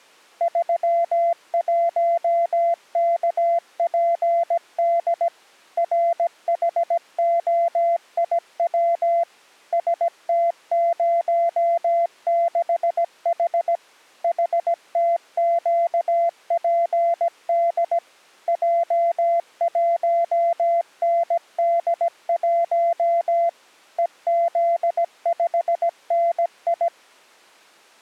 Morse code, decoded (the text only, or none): 31KPD RHOIW ST06H HTQPD J1ND1 EZ5NI